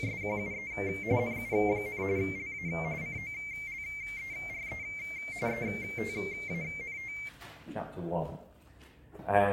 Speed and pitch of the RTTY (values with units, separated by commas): 45.45 baud, 170 Hz shift, 2200 Hz centre